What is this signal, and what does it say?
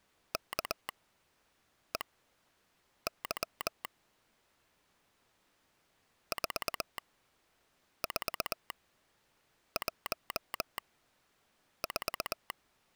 Morse code, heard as a telegraph sounder, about 20 wpm, spaced as for 7 wpm. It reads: KEY 4414